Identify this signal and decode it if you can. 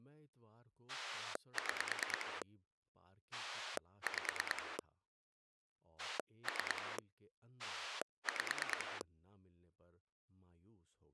Pulse dialling, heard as a rotary dial, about 9 pulses a second, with speech in Urdu. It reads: 6 5 3 5